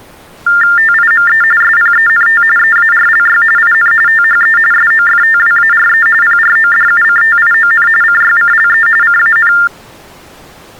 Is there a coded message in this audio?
Yes: TTY/TDD text telephone tones (45.45 baud Baudot) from 0.5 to 9.7 s, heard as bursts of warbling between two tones, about 400 Hz shift, 1600 Hz centre. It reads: TIME SPENT EARLY IN THE SOFTWARE PRODUCTION CYCLE CAN